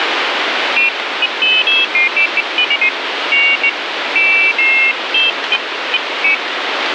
Pairs of high tones at irregular times, with radio static. There is no code.